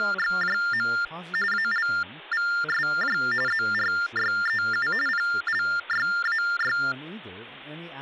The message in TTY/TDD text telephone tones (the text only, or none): … ALVSJ ZRYEU PLYAY